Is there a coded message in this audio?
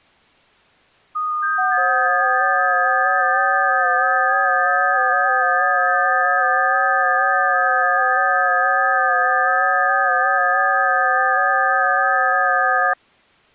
Yes: FT8 (several signals at once) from 1.1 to 12.9 s, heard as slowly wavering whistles, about 6.25 baud.